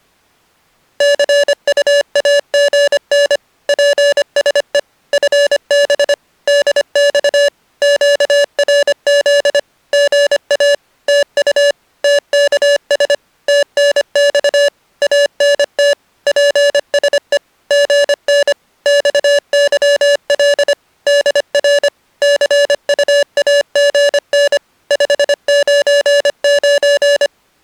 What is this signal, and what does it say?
Morse code, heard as electronic beeps, machine-sent, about 25 wpm, 570 Hz. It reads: CUAGN PSE FB DX QRZ GA TU TKS TNX ANT PSE GN XYL DR CUAGN 599